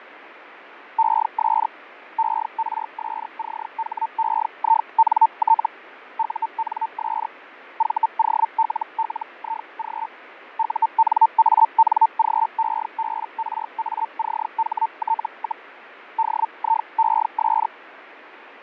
Hellschreiber (Feld-Hell, 122.5 baud), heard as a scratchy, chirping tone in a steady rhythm, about 900 Hz, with radio static and fading. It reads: ES ERSCHEINT UNS VOLLIG UNANGEBRACHT, DIES